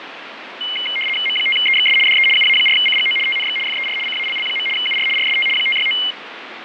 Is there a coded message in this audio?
Yes: RTTY (75 baud, 850 Hz shift) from 0.6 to 6.1 s, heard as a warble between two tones, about 2550 Hz centre, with radio static and fading. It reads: M5EXS DE UA4CGO TNX FER CALL. UR RST 569